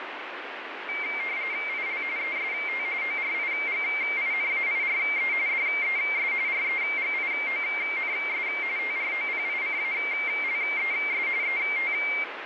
RTTY (45.45 baud, 170 Hz shift), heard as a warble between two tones, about 2200 Hz centre, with radio static. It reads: IL EST ORIGINAIRE DES REGIONS TROPICALES ET